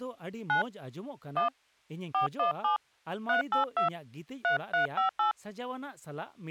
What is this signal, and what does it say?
DTMF, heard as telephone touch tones, dialled by hand, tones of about 120 ms, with speech in Santali. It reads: 9 1 417 382 3358